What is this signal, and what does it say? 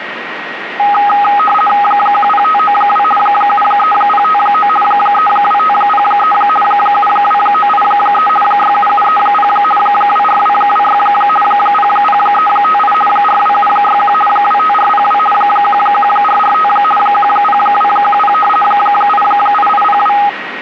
RTTY (50 baud, 450 Hz shift), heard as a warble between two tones, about 1040 Hz centre, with radio static and a steady whistle near 1890 Hz. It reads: 10592 73059 32503 72983 67730 24226 00358 42761 25402 11445 10210 88802